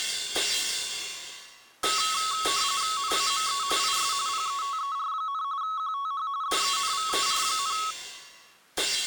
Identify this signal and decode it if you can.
RTTY (45.45 baud, 170 Hz shift), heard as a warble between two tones, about 1200 Hz centre. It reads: NAME IS PETER, QTH DENVER,